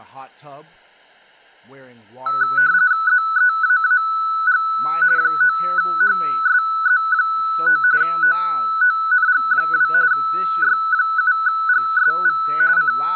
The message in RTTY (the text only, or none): ZEAAG 9HSZ9 OONG2 Y7GSV …